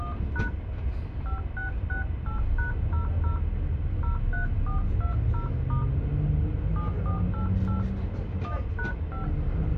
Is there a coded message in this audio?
Yes: DTMF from 0.0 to 9.2 s, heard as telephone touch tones, dialled by hand, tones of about 120 ms, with the noise inside a bus. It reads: 1# 5668#00 03420* 7488 1#5